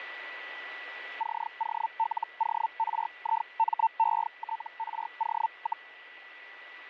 Hellschreiber (Feld-Hell, 122.5 baud), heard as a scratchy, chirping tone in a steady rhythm, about 900 Hz, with radio static and a steady whistle near 1960 Hz. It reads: COLORIMETRO,